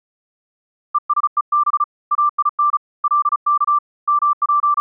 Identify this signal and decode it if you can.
Morse code (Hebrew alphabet), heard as a keyed tone, hand-sent with a paddle, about 35 wpm, 1180 Hz. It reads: ושוב אין לך …